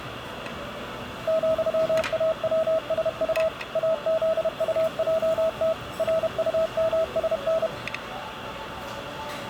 Morse code, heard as a keyed tone, machine-sent, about 31 wpm, 650 Hz, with radio static and the noise of a restaurant. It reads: ,AWSU AZUJT RUMSN